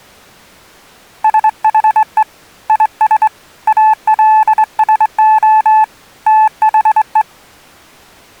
Morse code, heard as a keyed tone, hand-sent with a straight key, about 24 wpm, 870 Hz. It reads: SHE IS ALSO THE